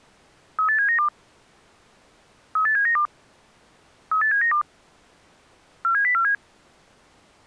Five-tone selective call (CCIR), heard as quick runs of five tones, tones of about 100 ms. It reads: 38792 38792 38792 47047